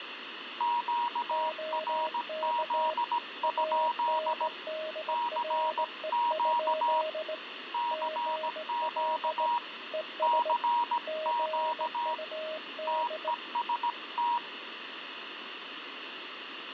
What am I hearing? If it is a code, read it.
Morse code, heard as two keyed tones, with radio static. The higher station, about 17 wpm, 950 Hz: QRZ? CQ CQ CQ TEST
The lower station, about 18 wpm, 630 Hz: OK ANDRE? GL ES GUD